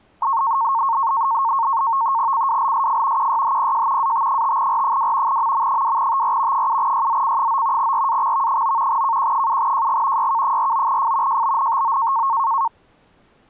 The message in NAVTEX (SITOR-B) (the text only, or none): CWLSF QYHPJ AT5R2 MM2TR 7YZC9 RAXV9 KQ7JG YK49F JBNTO